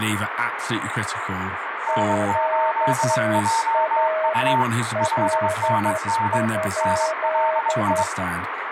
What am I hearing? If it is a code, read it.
Morse code, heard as two keyed tones, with radio static, room echo and speech in English. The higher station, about 22 wpm, 910 Hz: N8JU 5NN NLI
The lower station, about 11 wpm, 630 Hz: QRL?